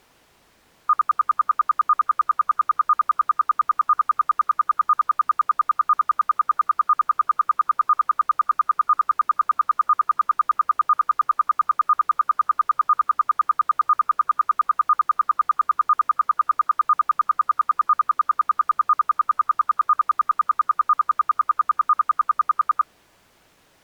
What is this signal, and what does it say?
Radio time signal (RWM, Moscow), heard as ten pulses a second.